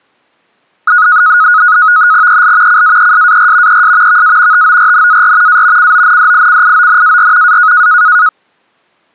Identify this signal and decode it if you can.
NAVTEX (SITOR-B), 100 baud, 170 Hz shift, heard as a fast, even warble, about 1360 Hz centre. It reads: EL CAESAR ES VA TORNAR A CONDICIONAR A